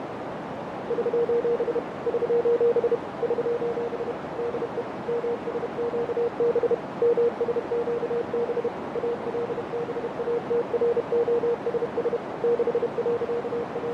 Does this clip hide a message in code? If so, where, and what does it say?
Yes: Morse code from 0.8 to 13.9 s, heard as a keyed tone, machine-sent, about 31 wpm, 470 Hz, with heavy radio static, fading and a narrow filter. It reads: <SOS> <SOS> <SOS> DE MSQB MSQB ALBATROSS …